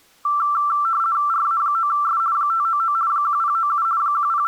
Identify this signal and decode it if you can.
RTTY (50 baud, 170 Hz shift), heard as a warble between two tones, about 1260 Hz centre. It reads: RA9S 599 1097 …